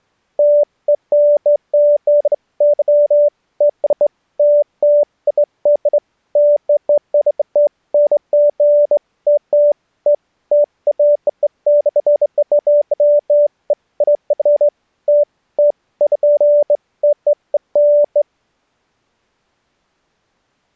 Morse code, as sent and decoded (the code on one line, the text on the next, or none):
none